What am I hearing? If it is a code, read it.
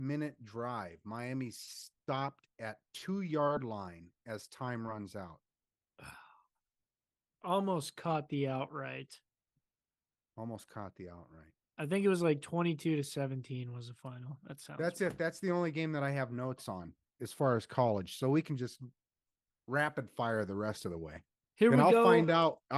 Speech in English. There is no code.